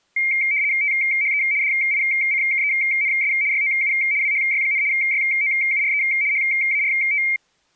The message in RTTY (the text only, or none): THE DICKENS YOU WHY, YOURE HART